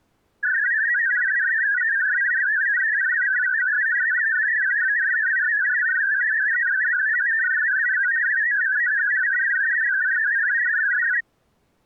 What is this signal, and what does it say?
Multi-tone FSK (Olivia or MFSK type), about 500 Hz wide, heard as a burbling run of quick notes, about 62.5 baud.